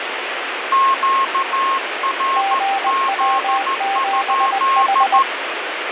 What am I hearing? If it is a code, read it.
Morse code, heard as two keyed tones, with radio static. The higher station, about 14 wpm, 1080 Hz: QRZ?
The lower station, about 20 wpm, 790 Hz: GW7H